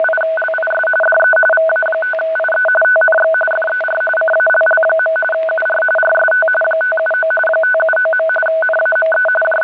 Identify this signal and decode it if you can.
RTTY (45.45 baud, 850 Hz shift), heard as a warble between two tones, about 1070 Hz centre, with static crashes. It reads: … DE VA5IE TNX FER CALL. UR RST 579 579. NAME …